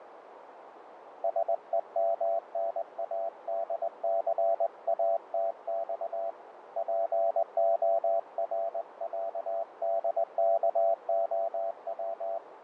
Morse code (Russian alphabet), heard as a keyed tone, hand-sent with a straight key, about 20 wpm, 670 Hz, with radio static, fading and a narrow filter. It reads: СЕМНАДЦАТЬ ПОРЯДКОВ